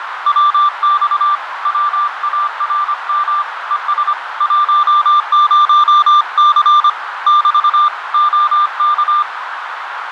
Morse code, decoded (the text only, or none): WX WARM ES 10C <BT> OK